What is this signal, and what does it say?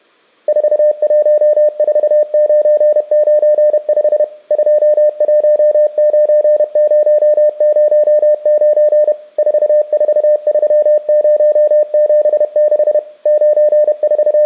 Morse code, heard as a keyed tone, machine-sent, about 31 wpm, 600 Hz. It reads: 414995 219009 443076 …